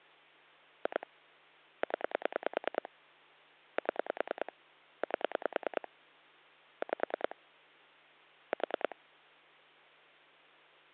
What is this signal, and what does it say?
Pulse dialling, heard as clicks on a phone line, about 10 pulses a second. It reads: 2 0 7 8 5 4